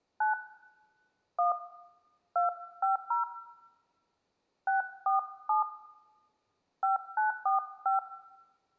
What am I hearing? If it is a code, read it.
DTMF, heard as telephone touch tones, dialled by hand, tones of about 140 ms, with room echo. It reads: 9 1 250 647 5945